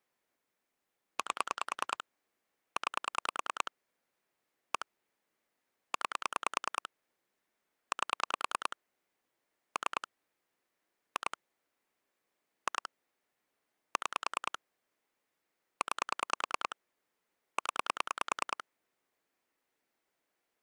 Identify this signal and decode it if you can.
Pulse dialling, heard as clicks on a phone line, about 10 pulses a second. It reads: 8 9 1 9 8 3 2 2 6 9 0